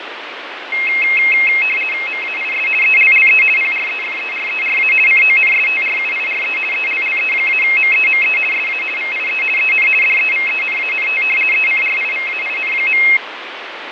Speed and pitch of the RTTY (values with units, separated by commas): 50 baud, 450 Hz shift, 2350 Hz centre